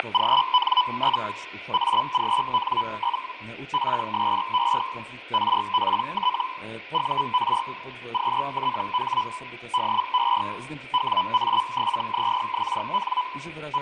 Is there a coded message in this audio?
Yes: Hellschreiber (Feld-Hell, 122.5 baud) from 0.0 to 13.8 s, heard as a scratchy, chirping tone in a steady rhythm, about 1000 Hz. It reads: … AGN? PSE RPT UR QTH DE WA7ZXN …